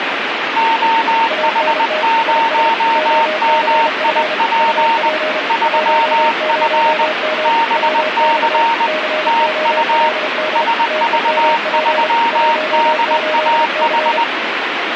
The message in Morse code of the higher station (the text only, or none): OH0MIP 3F BC TU SV3DAH